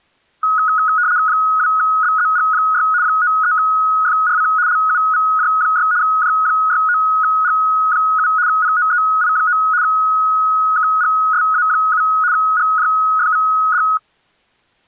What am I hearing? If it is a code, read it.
RTTY (75 baud, 170 Hz shift), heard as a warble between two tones, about 1360 Hz centre. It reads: 2BZG6 93FRC LUVJ6 J69G7 POEI9 KGSA7 GJFVD